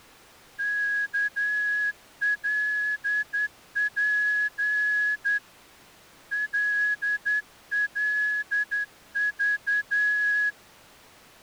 Morse code, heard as a whistle, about 10 wpm. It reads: KLP LLV